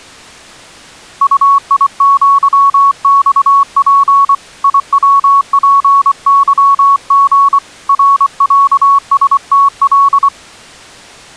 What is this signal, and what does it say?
Morse code (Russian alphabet), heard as a keyed tone, hand-sent with a paddle, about 24 wpm, 1110 Hz. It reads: УИЪЬП ИВПЫГ РЯСТЛ